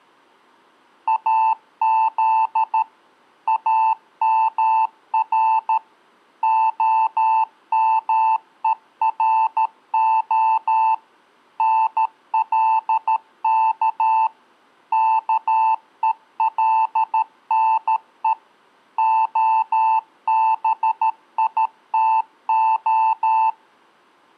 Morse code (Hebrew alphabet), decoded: אז אמר המורה נלך כולנו הביתה

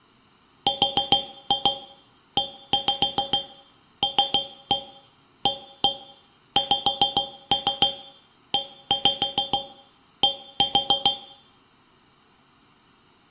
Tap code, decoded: RELAXED

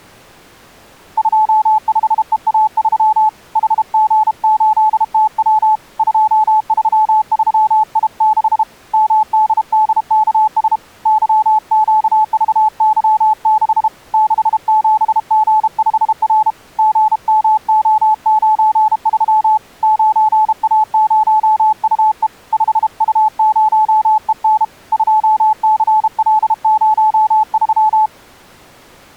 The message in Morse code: 25EA3 HG8TW 233I6 MDDKS YQVY6 67G5R GMO93 9A0UE 5U0EN 2CL03

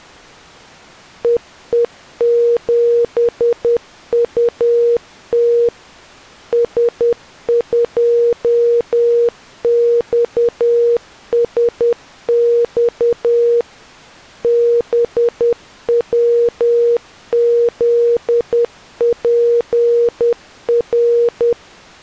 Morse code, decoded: EE7UT S2XSX BWZPR

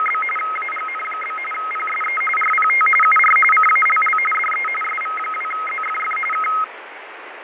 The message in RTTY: … AGN? PSE RPT UR CALL DE SV2ZFF K

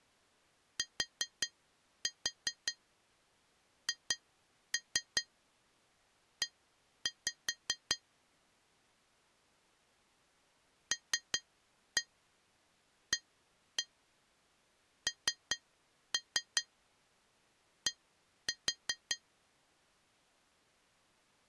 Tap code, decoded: THE LAND

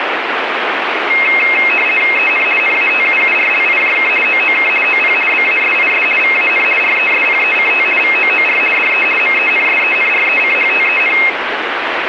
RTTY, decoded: EN NATUURLIJK OOK OP BASIS VAN RESPECT VOOR DE MENSENRECHTEN

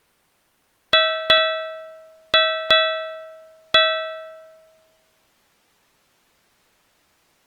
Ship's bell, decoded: 5

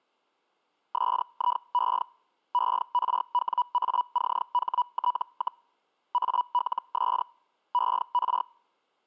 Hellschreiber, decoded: SIE ERWACHT, ALS ER

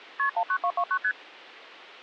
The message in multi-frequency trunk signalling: KP 19229 ST

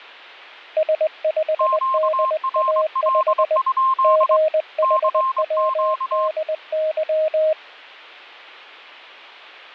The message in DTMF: none

